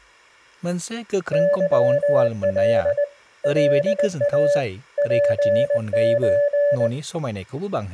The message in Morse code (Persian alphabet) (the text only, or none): ظل لا پچ